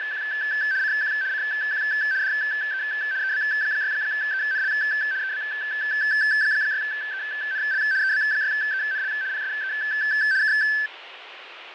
RTTY (75 baud, 170 Hz shift), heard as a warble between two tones, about 1650 Hz centre, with radio static and fading. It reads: … CQ CQ DE EB6ENL EB6ENL EB6ENL PSE K